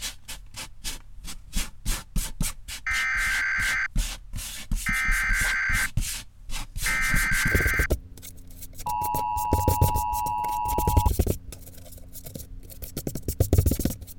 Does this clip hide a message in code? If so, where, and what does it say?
Yes: Emergency Alert System (SAME) tones (header bursts, then the 853 and 960 Hz attention tone) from 2.9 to 11.1 s, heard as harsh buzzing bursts, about 520.83 baud.